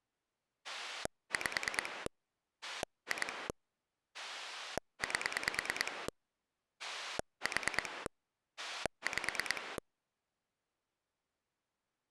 Pulse dialling, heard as a rotary dial, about 9 pulses a second. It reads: 5 2 8 4 5